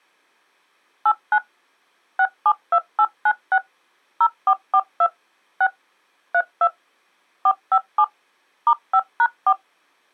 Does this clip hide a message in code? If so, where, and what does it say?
Yes: DTMF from 1.1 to 9.5 s, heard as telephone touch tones, dialled by machine, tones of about 60 ms. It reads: 89 672896 0442 6 32 457 *5#4